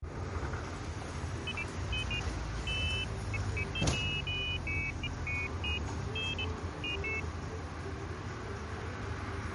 Pairs of high tones at irregular times, with street noise. There is no code.